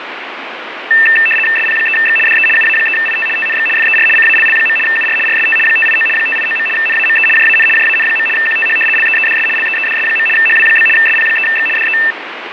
RTTY (75 baud, 850 Hz shift), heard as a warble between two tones, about 2250 Hz centre, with radio static. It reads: SP3X DE UA3IT TNX FER CALL. UR RST 589 589. NAME JAN JAN. QTH LEEDS LEEDS. HW? SP3X DE